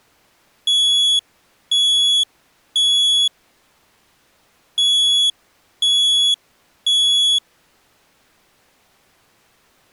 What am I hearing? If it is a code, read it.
Alarm pattern, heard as an alarm's beeps, played twice, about 3400 Hz. Temporal three. Smoke or fire, evacuate.